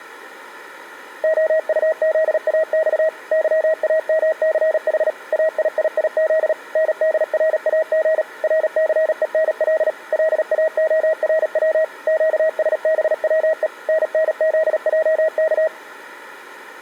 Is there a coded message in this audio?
Yes: Morse code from 1.2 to 15.7 s, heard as a keyed tone, machine-sent, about 37 wpm, 640 Hz. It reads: OUZAX YAMCH AIIIZ NDRAG RCENL LAORW QSBWE NNZJK